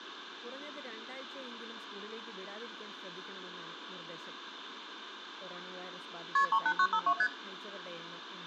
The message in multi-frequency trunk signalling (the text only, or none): KP 38952 ST